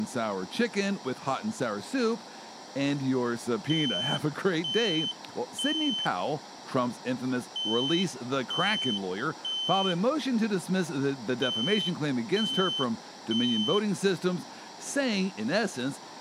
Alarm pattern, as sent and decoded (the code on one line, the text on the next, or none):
3 beeps and a pause
temporal three